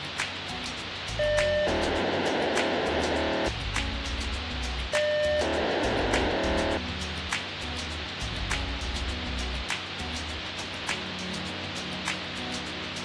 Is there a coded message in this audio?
Yes: POCSAG pager data (1200 baud) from 1.2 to 6.8 s, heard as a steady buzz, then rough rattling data, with radio hiss.